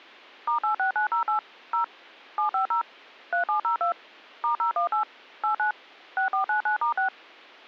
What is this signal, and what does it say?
DTMF, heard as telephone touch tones, dialled by machine, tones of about 110 ms. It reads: *86908 0 750 3702 *018 89 6499*6